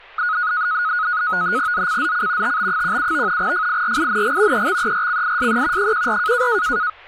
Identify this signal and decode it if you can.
NAVTEX (SITOR-B), 100 baud, 170 Hz shift, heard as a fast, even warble, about 1360 Hz centre, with speech in Gujarati. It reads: ZCZC TB17 FIRING EXERCISE 14